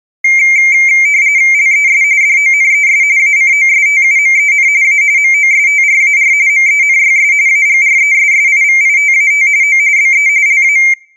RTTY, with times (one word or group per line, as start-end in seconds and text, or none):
1.5-2.0 LES
2.2-3.0 DONES
3.2-4.7 ACOSTUMEN
4.8-5.0 A
5.2-6.3 MOSTRAR
6.5-7.3 MENYS
7.5-9.5 AGRESSIVITAT
9.6-9.8 O
10.0-10.3 BE
10.5-10.8 LA